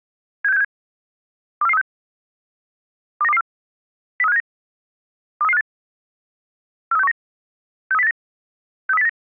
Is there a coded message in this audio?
Yes: five-tone selective call (EEA) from 0.4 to 9.1 s, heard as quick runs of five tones, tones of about 40 ms. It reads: 76767 24436 29224 03579 23358 43619 63089 63089